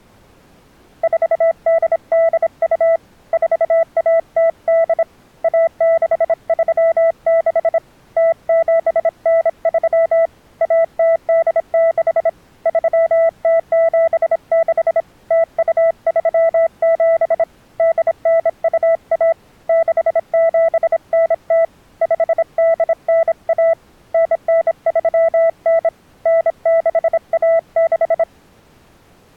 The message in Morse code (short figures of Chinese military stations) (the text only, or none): 4882 4108 1636 0793 1086 3076 0237 8921 6790 5891 9939 9616